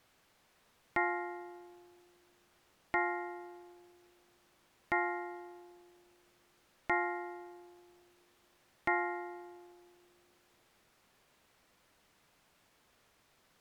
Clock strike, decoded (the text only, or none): 5